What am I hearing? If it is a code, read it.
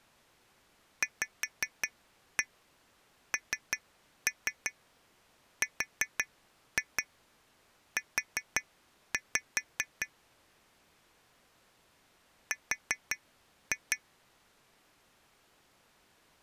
Tap code, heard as taps on glass, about 5 knocks a second. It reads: VNRU R